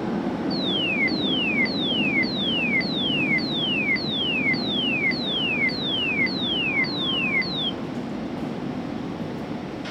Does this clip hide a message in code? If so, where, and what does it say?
No, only a tone that sweeps in pitch again and again, with radio hiss, a squelch burst at the end and the noise of a subway station.